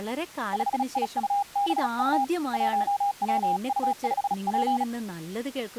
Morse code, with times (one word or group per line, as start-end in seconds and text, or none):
0.5-2.2 5IUBU
2.5-4.8 1WU5P